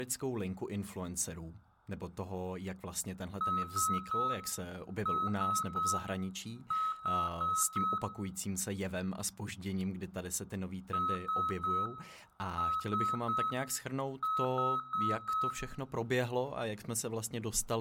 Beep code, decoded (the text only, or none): 3-3-4